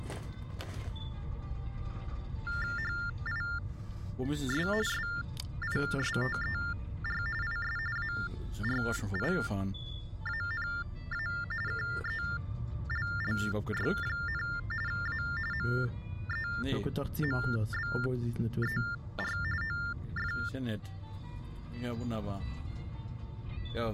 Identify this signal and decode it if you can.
TTY/TDD text telephone tones (45.45 baud Baudot), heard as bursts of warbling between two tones, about 400 Hz shift, 1600 Hz centre. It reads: HIS SISTER IS ARIANA KELLY, A MEMBER OF